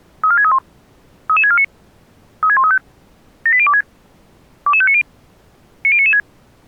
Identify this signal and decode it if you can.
Five-tone selective call (ZVEI), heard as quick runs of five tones, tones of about 70 ms. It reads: 34631 33649 36135 78026 22590 90996